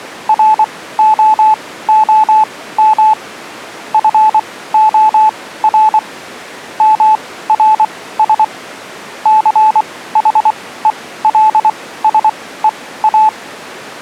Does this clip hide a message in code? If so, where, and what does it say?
Yes: Morse code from 0.2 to 13.3 s, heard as a keyed tone, machine-sent, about 24 wpm, spaced as for 16 wpm, 870 Hz. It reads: ROOM FOR MRS CHELSEA